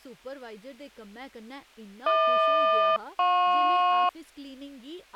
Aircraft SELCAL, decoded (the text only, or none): HQ-JP